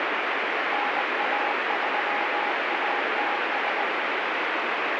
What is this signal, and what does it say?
Morse code, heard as a keyed tone, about 19 wpm, 820 Hz, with heavy radio static. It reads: NA3ATS